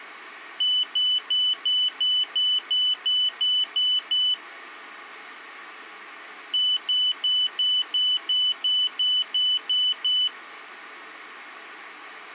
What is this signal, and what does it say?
Beep code, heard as a piezo beeper, played twice, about 3000 Hz. 11 short. In AMI BIOS tables: cache memory error.